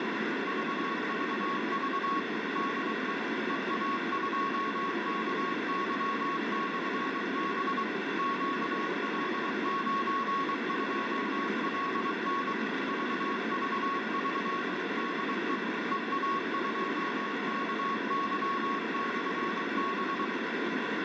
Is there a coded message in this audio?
Yes: Morse code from 0.4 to 20.3 s, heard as a keyed tone, machine-sent, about 23 wpm, 1100 Hz, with heavy radio static. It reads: VVV DE EA2KY/B QL92LN VVV DE EA2KY/B